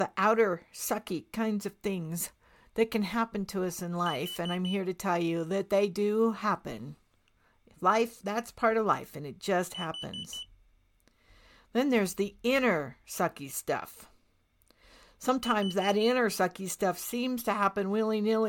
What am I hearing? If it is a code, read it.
Alarm pattern, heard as an alarm's beeps, played three times, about 3000 Hz, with speech in English. Temporal four. Carbon monoxide.